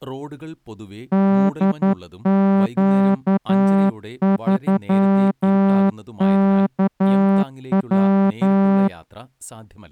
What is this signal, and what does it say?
Morse code, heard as a horn, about 11 wpm, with speech in Malayalam. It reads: DQ3KW